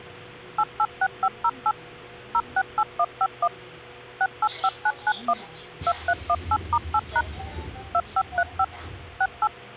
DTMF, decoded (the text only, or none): 886508 068151 685991 2318*8# 2535 68